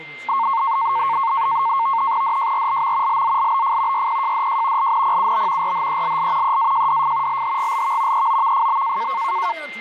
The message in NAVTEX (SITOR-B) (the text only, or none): DJRLM LZLBF YPJDJ LNPUB RHELL EAJDF LHGLV EOVFB